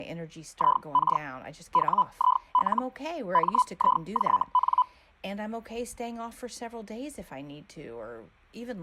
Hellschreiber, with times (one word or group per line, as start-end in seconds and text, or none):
0.5-1.2 IK
1.7-2.8 WIL
3.3-4.8 MIJN